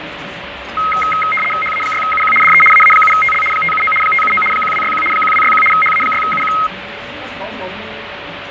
RTTY (75 baud, 850 Hz shift), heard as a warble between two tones, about 1700 Hz centre, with radio static, fading and the noise of a restaurant. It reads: HA6UQ DE AA7TL 579 579 1261 1261 HA6UQ